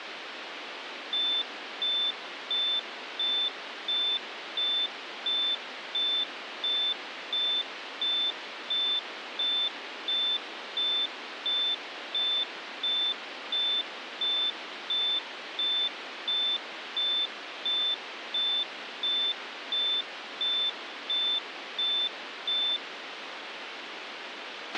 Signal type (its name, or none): none